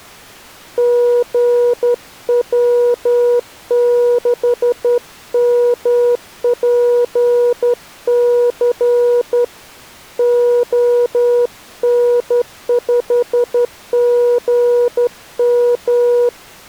Morse code, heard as a keyed tone, hand-sent with a straight key, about 11 wpm, 480 Hz. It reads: GW6MPC ON5GM